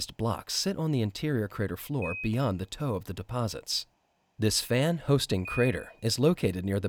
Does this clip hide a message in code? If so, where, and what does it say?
Yes: Quindar tones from 2.0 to 5.7 s, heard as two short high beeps, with room echo.